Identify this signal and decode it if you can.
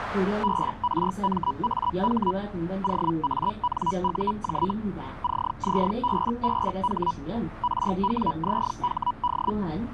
Hellschreiber (Feld-Hell, 122.5 baud), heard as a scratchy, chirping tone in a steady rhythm, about 980 Hz, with the noise inside a bus. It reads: BRMAH OANUJ CZBBH RWZHD